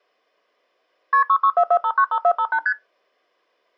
Multi-frequency trunk signalling (R1, as on North American trunks), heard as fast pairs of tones, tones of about 70 ms. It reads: KP 6644595458 ST